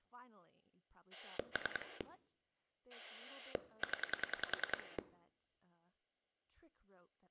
Pulse dialling, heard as a rotary dial, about 10 pulses a second, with speech in English. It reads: 3 0